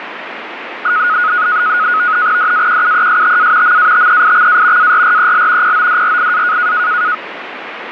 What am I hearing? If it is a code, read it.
NAVTEX (SITOR-B), 100 baud, 170 Hz shift, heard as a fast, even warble, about 1360 Hz centre, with radio static. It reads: DAQUESTA MATEIXA ARREL PODRIA